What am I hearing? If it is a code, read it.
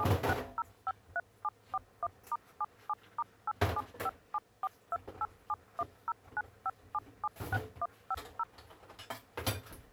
DTMF, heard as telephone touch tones, dialled by machine, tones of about 40 ms, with kitchen noise. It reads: 76053741*77*875742871095776150